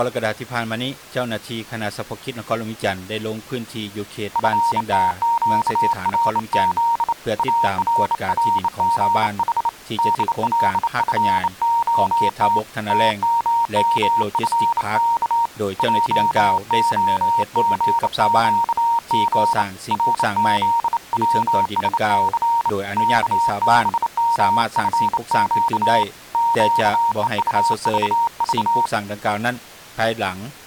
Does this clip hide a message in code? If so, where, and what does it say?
Yes: Morse code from 4.3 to 28.9 s, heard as a keyed tone, hand-sent with a bug key, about 28 wpm, 930 Hz. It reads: FTQRZ ARRGH DLFOT TMMFK JOGQG RZWSC KBMFQ QEUVV